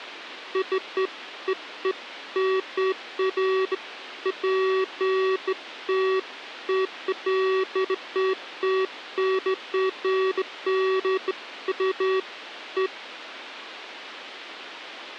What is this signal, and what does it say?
Beeps of irregular length. There is no code.